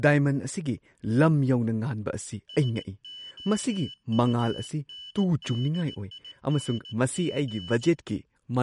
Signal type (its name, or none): Morse code